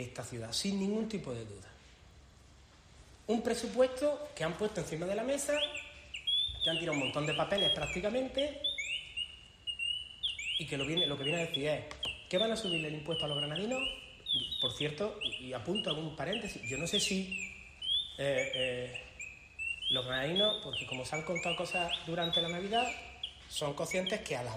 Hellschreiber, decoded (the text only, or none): none